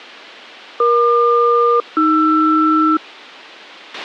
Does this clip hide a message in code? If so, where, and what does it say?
Yes: aircraft SELCAL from 0.8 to 3.0 s, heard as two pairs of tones, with a squelch burst at the end. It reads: EQ-AR